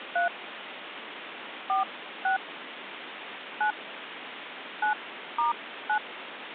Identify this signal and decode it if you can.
DTMF, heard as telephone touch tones, dialled by hand, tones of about 120 ms, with phone line noise. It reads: 3 46 9 9*9